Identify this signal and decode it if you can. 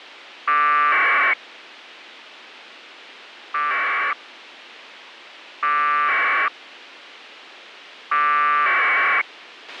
Packet radio (AX.25, as in APRS), 1200 baud, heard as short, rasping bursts, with a squelch burst at the end.